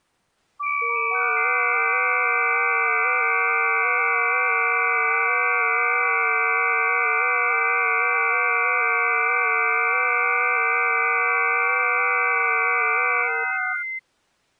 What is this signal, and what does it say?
FT8 (several signals at once), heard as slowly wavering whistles, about 6.25 baud.